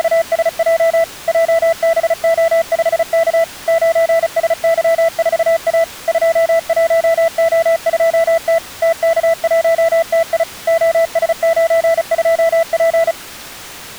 Morse code, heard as a keyed tone, machine-sent, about 35 wpm, 660 Hz. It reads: … JBO5K 9SY4A 21O2T TK1TI OS92P